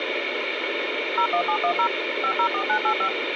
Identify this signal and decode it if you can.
DTMF, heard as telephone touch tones, dialled by machine, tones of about 80 ms, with phone line noise. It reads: 01710 504985